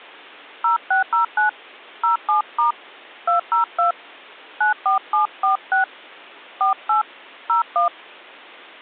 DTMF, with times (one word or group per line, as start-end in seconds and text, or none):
0.6-1.5 0609
2.0-2.7 07*
3.3-3.9 202
4.6-5.8 94746
6.6-7.0 48
7.5-7.9 01